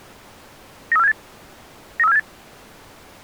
Five-tone selective call (EEA), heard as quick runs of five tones, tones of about 40 ms. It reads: 93478 93478